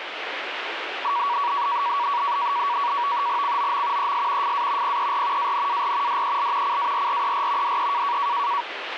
NAVTEX (SITOR-B), 100 baud, 170 Hz shift, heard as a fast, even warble, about 1040 Hz centre, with radio static. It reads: COM ES FA PER ANAR DEL CARRER DE